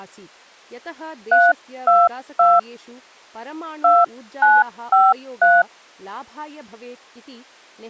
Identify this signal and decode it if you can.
DTMF, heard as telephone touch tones, dialled by hand, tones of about 200 ms, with speech in Sanskrit. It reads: 322 2953